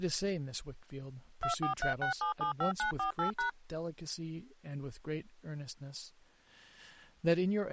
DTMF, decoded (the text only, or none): 2436775948#